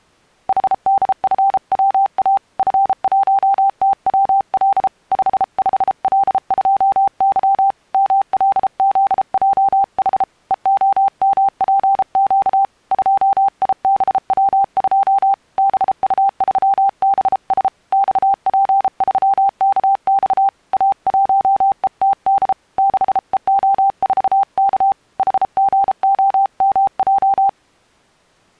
Morse code, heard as a keyed tone, hand-sent with a paddle, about 33 wpm, 790 Hz. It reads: HDFWA F1TWL 55L2Y MLZJH EOMPQ 2IBW2 BU3BS XP3KX A1ETD 6EO4K HGOMJ